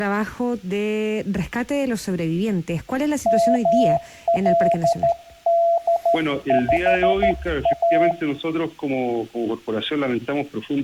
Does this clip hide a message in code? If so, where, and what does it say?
Yes: Morse code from 3.2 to 8.2 s, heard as a keyed tone, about 13 wpm, 680 Hz. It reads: MLD5A